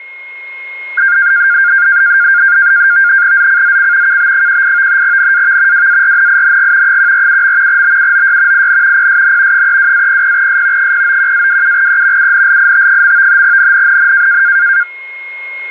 NAVTEX (SITOR-B), 100 baud, 170 Hz shift, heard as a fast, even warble, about 1500 Hz centre, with a steady whistle near 2150 Hz. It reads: ZCZC KB18 NAV WARNING 147. BUOY IN PSN 32-00S 091-27E UNLIT. NNNN